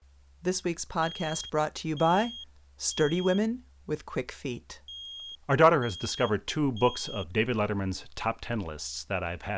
Alarm pattern, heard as an alarm's beeps, played twice, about 3250 Hz, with speech in English. Temporal three. Smoke or fire, evacuate.